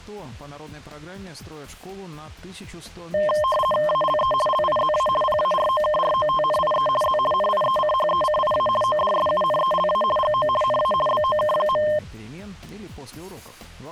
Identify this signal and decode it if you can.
RTTY (50 baud, 450 Hz shift), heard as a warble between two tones, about 830 Hz centre. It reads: ALE LIZA PAROKROTNIE Z NIECHECIA ODSUNELA GO NA BOK.